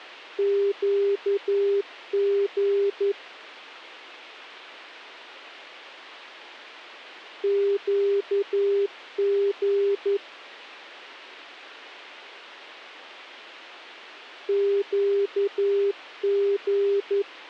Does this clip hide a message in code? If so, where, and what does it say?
Yes: Morse code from 0.3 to 17.3 s, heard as a keyed tone, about 11 wpm, 400 Hz. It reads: QG QG QG